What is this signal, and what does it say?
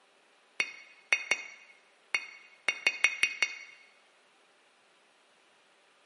Tap code, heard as taps on a metal pipe, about 6 knocks a second, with room echo. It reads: BE